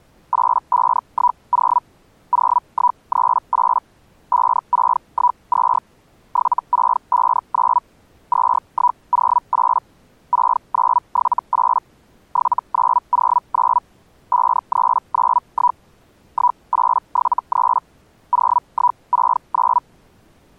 Hellschreiber (Feld-Hell, 122.5 baud), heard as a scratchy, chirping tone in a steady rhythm, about 980 Hz. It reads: 8510 0138 5612 7659 2108 6978 7909 5391 1873 0169